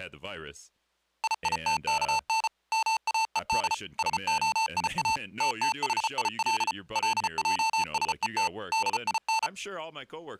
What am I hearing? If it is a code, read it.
Morse code (Hebrew alphabet), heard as electronic beeps, machine-sent, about 34 wpm, 890 Hz, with speech in English. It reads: ייתכן מאוד שהיא תתחיל לעשות דין